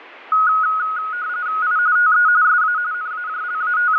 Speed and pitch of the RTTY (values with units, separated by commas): 45.45 baud, 170 Hz shift, 1360 Hz centre